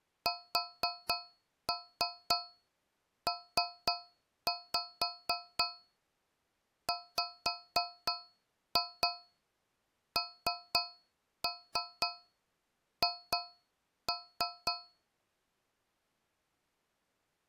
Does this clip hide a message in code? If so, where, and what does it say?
Yes: tap code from 0.3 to 15.1 s, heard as taps on a metal pipe, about 4 knocks a second. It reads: SPWNH